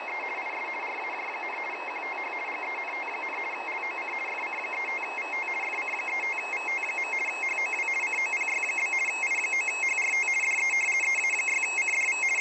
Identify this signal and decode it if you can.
RTTY (50 baud, 450 Hz shift), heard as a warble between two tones, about 2350 Hz centre, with radio static and fading. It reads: … IS RAJ, QTH GENT, LOC FC35VT FC35VT. HOW COPY? I9HRT DE EA6CDV …